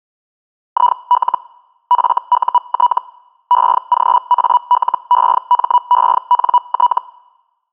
Hellschreiber (Feld-Hell, 122.5 baud), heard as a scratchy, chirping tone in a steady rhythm, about 980 Hz. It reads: IL FUT EGALEMENT